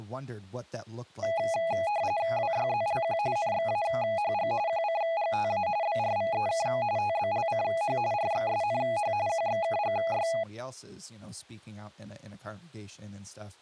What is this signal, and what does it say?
RTTY (45.45 baud, 170 Hz shift), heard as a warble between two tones, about 750 Hz centre, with speech in English. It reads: WYZLQ NXAHG QCGTA BRVEK TBLCH RXSNH QXKGY